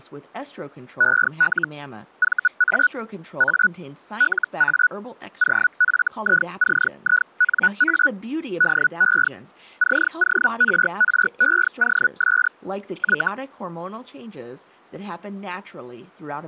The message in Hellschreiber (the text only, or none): EL VA A LA OFICINA DE CORREOS Y